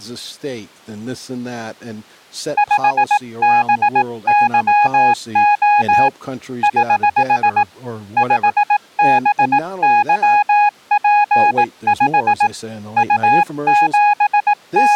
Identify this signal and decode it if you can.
Morse code, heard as a keyed tone, hand-sent with a paddle, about 18 wpm, 830 Hz, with speech in English. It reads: 5BYO <HH> 5BYP5 …